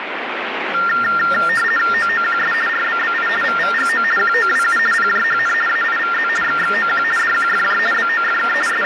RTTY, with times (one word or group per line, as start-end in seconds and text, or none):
1.9-2.5 OOQS
2.7-3.3 RBBI
3.4-4.0 VVGO
4.2-4.8 QOWU
4.9-5.5 PJHN
5.7-6.3 AIVZ
6.4-7.0 XXOQ
7.2-7.8 DQFJ
7.9-8.5 BOFK
8.7-8.9 …